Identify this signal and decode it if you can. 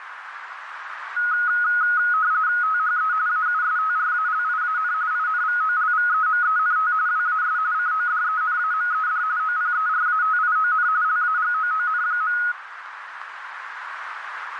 RTTY (45.45 baud, 170 Hz shift), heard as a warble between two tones, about 1360 Hz centre, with radio static and a narrow filter. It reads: THE AUSTRALIAN INVOLVEMENT WAS CODENAMED OPERATION LAGOON.